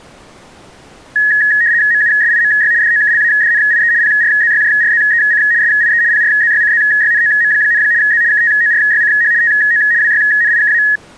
RTTY (75 baud, 170 Hz shift), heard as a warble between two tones, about 1800 Hz centre. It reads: MUSIMY DOKLADNIE PRZYJRZEC SIE PRZYCZYNOM, Z KTORYCH TO WYNIKA